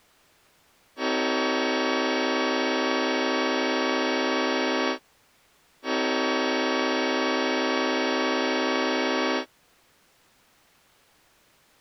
Train horn signal, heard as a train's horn. 2 long. On North American railways: brakes released, proceed.